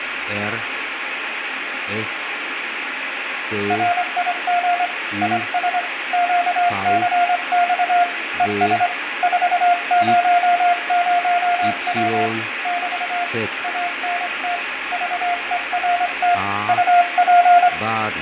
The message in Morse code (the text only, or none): RIG IS QCX ES 400W <BT> ANT VERT UP